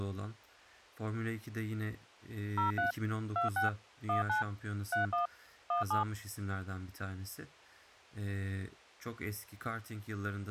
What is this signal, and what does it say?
DTMF, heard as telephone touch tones, dialled by machine, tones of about 130 ms, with speech in Turkish. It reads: 03 26 19 31 17